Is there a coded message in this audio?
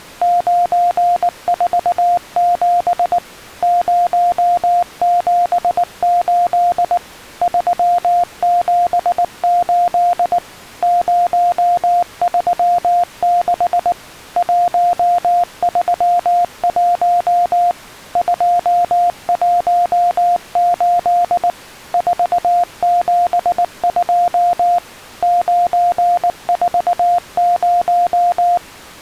Yes: Morse code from 0.2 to 28.6 s, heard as a keyed tone, machine-sent, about 19 wpm, 700 Hz. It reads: 947 078 378 036 131 218 472 940